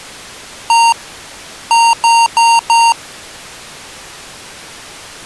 Beep code, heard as beeps from a small speaker, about 920 Hz. 1-4.